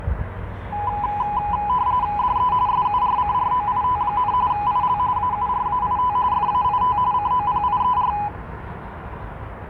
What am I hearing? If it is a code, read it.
RTTY (45.45 baud, 170 Hz shift), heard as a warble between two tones, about 910 Hz centre, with street noise. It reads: DE SURCROIT, IL AURAIT FAIT COPIER